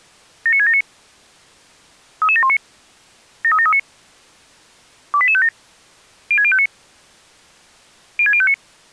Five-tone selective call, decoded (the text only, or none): 79679 33719 73739 28857 06059 06059